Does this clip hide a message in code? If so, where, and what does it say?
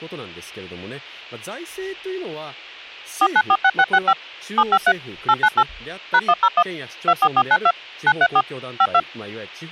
Yes: DTMF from 3.2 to 9.0 s, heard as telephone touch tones, dialled by machine, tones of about 60 ms, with speech in Japanese. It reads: 4946665 753 898 #101 24492 934 52